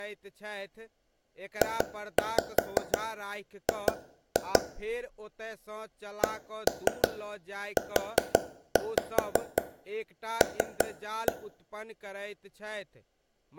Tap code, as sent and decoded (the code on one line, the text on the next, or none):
2-5 2-2 / 1-3 4-5 3-1
JG CUL